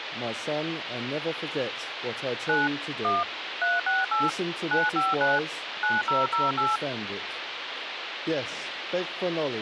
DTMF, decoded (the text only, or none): 9 1 368 959 9008